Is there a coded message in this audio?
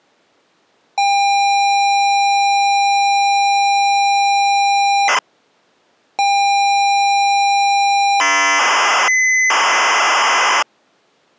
Yes: ZX Spectrum tape loading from 1.0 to 10.6 s, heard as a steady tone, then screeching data.